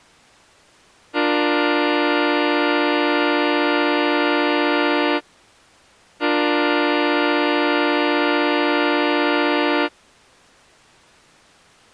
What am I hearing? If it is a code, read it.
Train horn signal, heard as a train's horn. 2 long. On North American railways: brakes released, proceed.